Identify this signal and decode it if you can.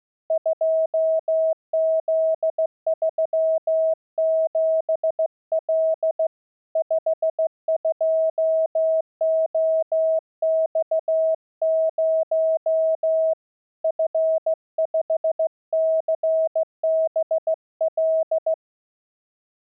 Morse code, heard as a keyed tone, hand-sent with a straight key, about 15 wpm, 640 Hz. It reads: 2Z37L 52OX0 F5CBL